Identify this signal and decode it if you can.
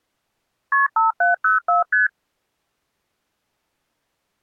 Multi-frequency trunk signalling (R1, as on North American trunks), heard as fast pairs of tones, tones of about 140 ms. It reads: KP 5704 ST